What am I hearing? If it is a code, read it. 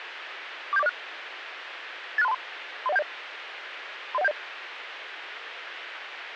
Five-tone selective call (EIA), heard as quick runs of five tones, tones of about 30 ms, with radio hiss. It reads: 47406 86323 30170 30170